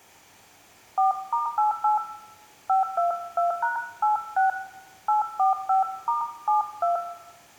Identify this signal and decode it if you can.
DTMF, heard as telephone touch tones, dialled by hand, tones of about 140 ms, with room echo. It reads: 4*88 522#86 845*72